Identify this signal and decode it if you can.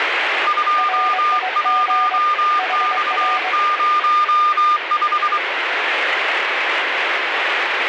Morse code, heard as two keyed tones, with radio static. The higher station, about 24 wpm, 1210 Hz: 21X05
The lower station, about 23 wpm, 740 Hz: RIG HR